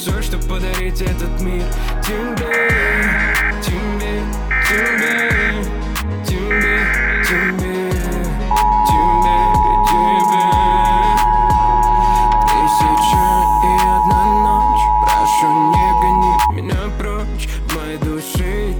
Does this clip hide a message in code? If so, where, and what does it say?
Yes: Emergency Alert System (SAME) tones (header bursts, then the 853 and 960 Hz attention tone) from 2.5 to 16.5 s, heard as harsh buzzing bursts, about 520.83 baud.